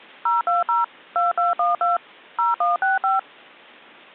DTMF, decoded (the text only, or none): 020 2212 0165